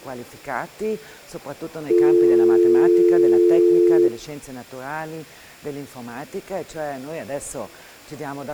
Telephone call progress tone (North American or UK plan), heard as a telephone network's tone, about 350, 440 Hz. Dial tone.